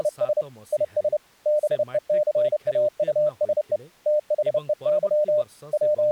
Morse code, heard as a keyed tone, hand-sent with a paddle, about 30 wpm, 600 Hz, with speech in Odia. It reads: … IS BECAUSE THEY …